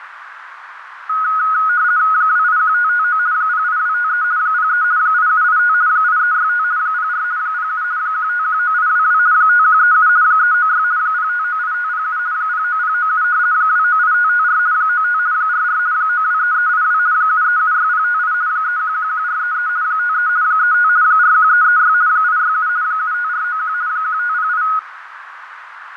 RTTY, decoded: 281559 08253 03 8785 8365 04 07 1519822 5137 396 0598507 09097 298554 95 44 923382 7376058 3111433 53 35 41336 867 75491 1508

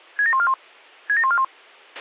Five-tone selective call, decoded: 67141 67141

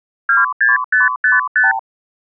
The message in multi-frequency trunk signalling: 26555

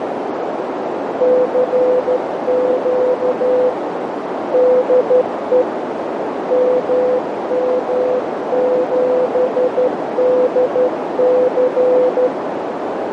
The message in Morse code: CQ DE MM7DC

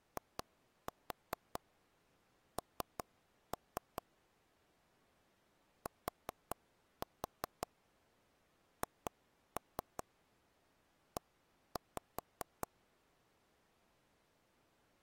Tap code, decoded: IN THE

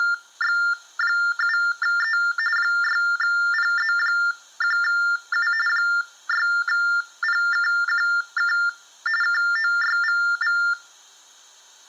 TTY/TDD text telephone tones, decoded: … 6PZ1U 6PKQK KOYVV

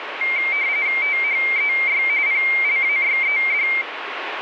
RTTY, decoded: THEY PLAYED

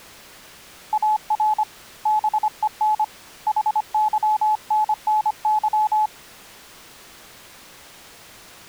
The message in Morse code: AR BEN HYNNY

